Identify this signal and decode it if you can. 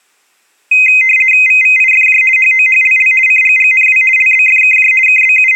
RTTY (50 baud, 450 Hz shift), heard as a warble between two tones, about 2300 Hz centre. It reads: VVIFJ HOHLL CGGNW LBFKJ …